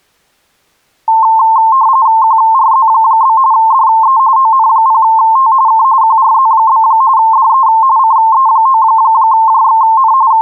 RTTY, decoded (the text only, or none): QRZ? DE ON0T K QRZ? DE CE9JXN …